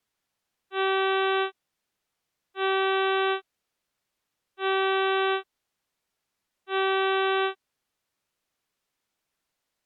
Ship horn signal, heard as a ship's horn, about 380 Hz. 4 short. At sea: a pilot vessel's identity signal in fog.